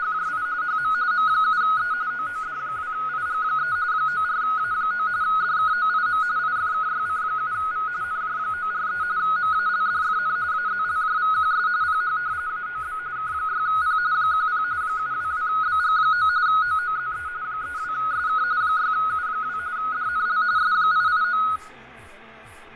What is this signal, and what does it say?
RTTY (45.45 baud, 170 Hz shift), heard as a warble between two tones, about 1360 Hz centre, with radio static, fading and room echo. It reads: … HM M7E OOD2IG3 94A9 DKOIM IFKYC7V NJ943 MALDFN AZLJVQS PH AOB K6P 10 722BG9 OOZE 32SK 6U2 DNL S889